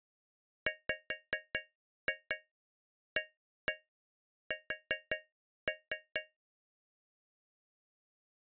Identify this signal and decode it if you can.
Tap code, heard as taps on a metal pipe, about 5 knocks a second. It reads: WAS